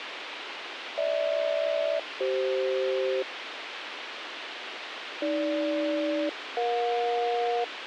Aircraft SELCAL, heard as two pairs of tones, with radio hiss. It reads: GH-CF AG-EJ